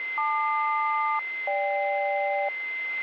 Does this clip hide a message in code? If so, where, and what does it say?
Yes: aircraft SELCAL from 0.2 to 2.5 s, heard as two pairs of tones, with a steady whistle near 2070 Hz. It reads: LQ-GK